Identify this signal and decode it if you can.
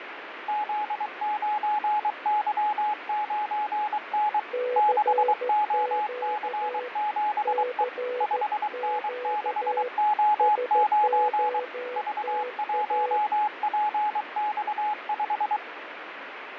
Morse code, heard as two keyed tones, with radio static and fading. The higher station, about 23 wpm, 840 Hz: Z9Y9N 6OC7E 5N6O9 V1PX5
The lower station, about 14 wpm, 500 Hz: CQ CQ SOTA